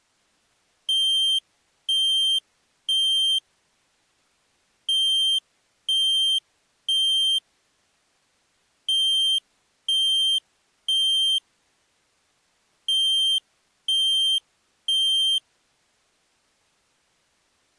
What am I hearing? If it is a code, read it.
Alarm pattern, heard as an alarm's beeps, played four times, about 3150 Hz. Temporal three. Smoke or fire, evacuate.